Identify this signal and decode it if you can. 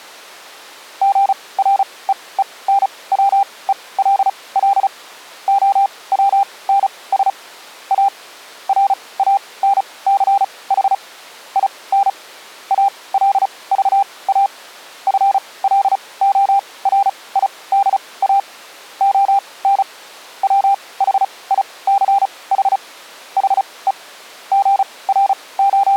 Morse code, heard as a keyed tone, machine-sent, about 35 wpm, spaced as for 22 wpm, 800 Hz. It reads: GREENWELL OWNS A RANCH IN ALVA FLORIDA ON WHICH HE …